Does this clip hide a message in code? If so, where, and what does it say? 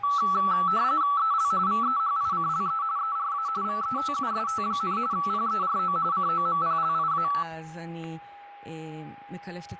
Yes: RTTY (45.45 baud, 170 Hz shift) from 0.0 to 7.4 s, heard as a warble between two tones, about 1230 Hz centre, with static crashes, a steady whistle near 810 Hz and speech in Hebrew. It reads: EL VEHICLE ERA VETUST, PERO COMPLIA